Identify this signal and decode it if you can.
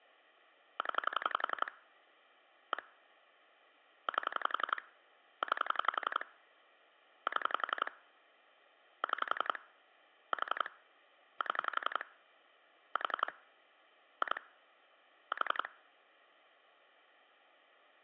Pulse dialling, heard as clicks on a phone line, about 11 pulses a second. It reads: 0 1 8 9 7 6 4 7 4 2 4